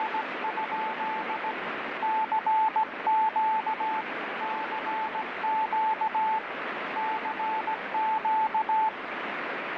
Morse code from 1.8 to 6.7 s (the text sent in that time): CQ CQ